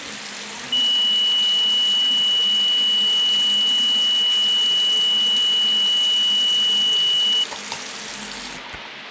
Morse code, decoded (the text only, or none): none